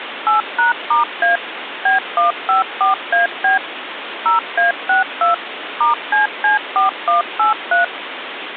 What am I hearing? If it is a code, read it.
DTMF, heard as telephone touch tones, dialled by machine, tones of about 140 ms, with phone line noise. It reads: 8#*A B154AB 0A62 *CC4183